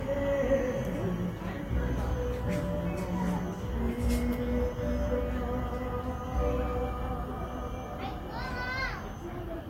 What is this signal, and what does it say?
The noise of a park. There is no code.